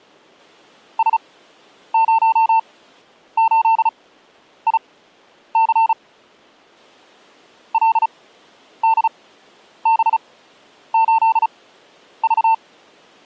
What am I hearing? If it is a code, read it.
Morse code, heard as a keyed tone, machine-sent, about 35 wpm, spaced as for 10 wpm, 900 Hz. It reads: S08IC LDB8V